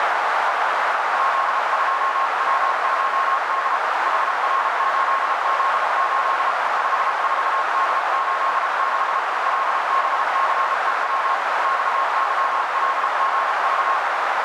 Morse code, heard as a keyed tone, hand-sent with a paddle, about 33 wpm, 1080 Hz, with heavy radio static and a narrow filter. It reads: Z2W2D HR8Z8 54D86 LBCEW XYLGV